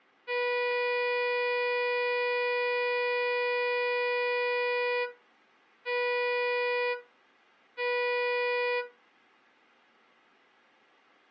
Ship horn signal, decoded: 1 long, 2 short

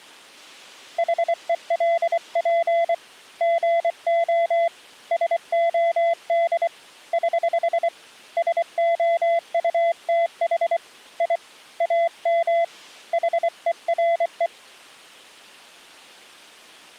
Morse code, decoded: HELP GO SOD <HH> SOUTH I AM HERE

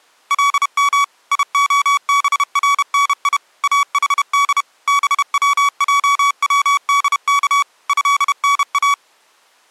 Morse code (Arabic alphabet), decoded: لم يخبرني احد بوجودك هنا

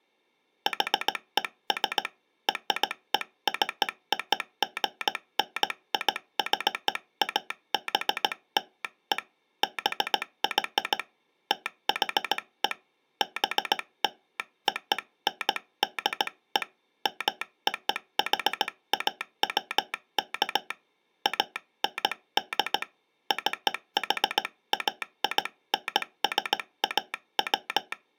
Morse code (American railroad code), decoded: HES RECOGNIZABLE BY THE BLONDE MOHAWK AND CHAINSAW

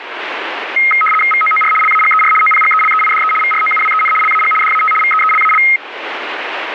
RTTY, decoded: VOOR LAGER OPGELEIDE VROUWEN LAG DAT VEELAL

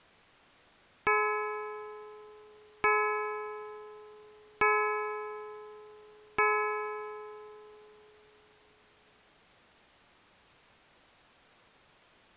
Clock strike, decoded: 4

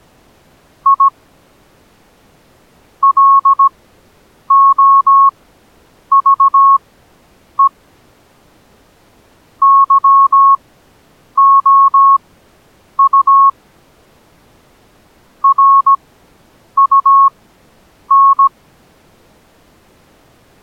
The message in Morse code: I LOVE YOU RUN

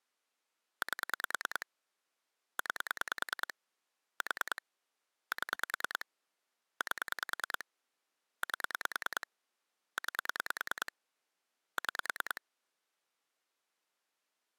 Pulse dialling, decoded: 8 9 4 7 8 8 9 6

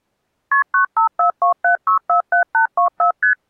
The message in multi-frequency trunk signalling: KP 95427647824 ST

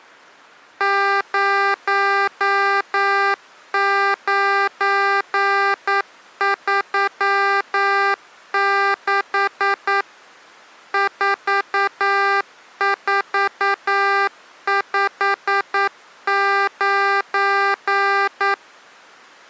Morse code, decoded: 0936 4459

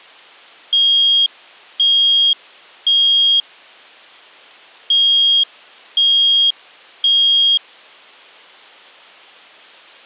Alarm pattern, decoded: temporal three

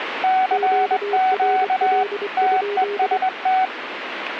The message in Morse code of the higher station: CQ TEST

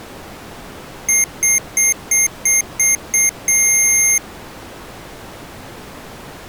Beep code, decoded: 7 short, 1 long

